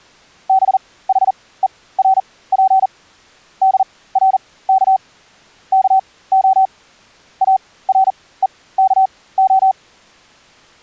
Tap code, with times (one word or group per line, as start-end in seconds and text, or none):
none